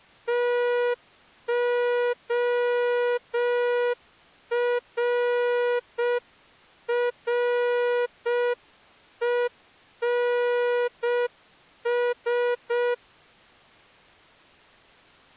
Morse code, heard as a horn, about 6 wpm. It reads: TORRENS